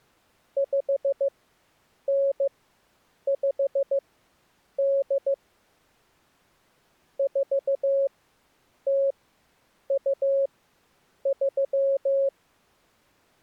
Morse code (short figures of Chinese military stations), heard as a keyed tone, machine-sent, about 15 wpm, spaced as for 8 wpm, 550 Hz. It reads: 5958 4023